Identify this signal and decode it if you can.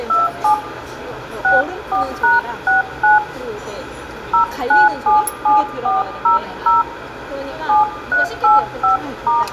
DTMF, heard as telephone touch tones, dialled by hand, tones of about 140 ms, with phone line noise, room echo and the noise of a restaurant. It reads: 27 64#69 0977400 7385*